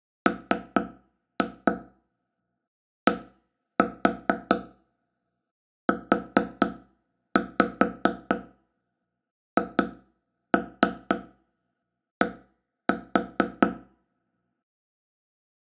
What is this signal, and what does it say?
Tap code, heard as taps on a table, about 4 knocks a second, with room echo. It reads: MDUHD